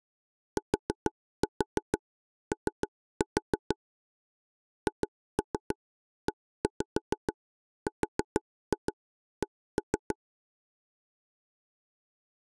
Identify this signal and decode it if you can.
Tap code, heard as taps on a table, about 6 knocks a second. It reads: TO HERC